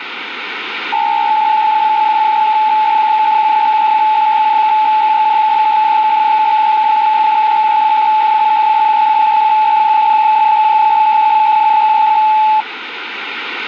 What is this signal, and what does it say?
PSK63 (62.5 baud), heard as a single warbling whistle, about 860 Hz, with radio static.